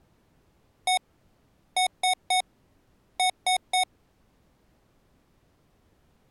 Beep code, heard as beeps from a small speaker, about 740 Hz. 1-3-3. In Phoenix BIOS tables: chip or data line failure in the first 64 KB of memory.